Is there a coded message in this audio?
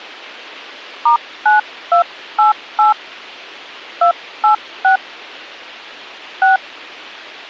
Yes: DTMF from 1.1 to 6.6 s, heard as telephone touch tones, dialled by hand, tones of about 110 ms. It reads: *9288 286 6